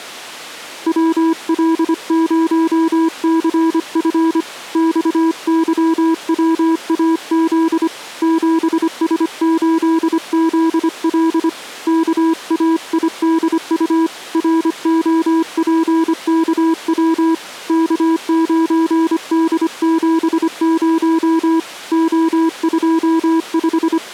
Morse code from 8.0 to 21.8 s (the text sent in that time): 7S8ZL KAIDU ROPKW K9D70